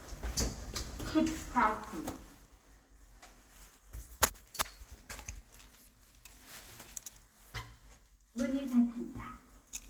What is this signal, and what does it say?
The noise inside a lift. There is no code.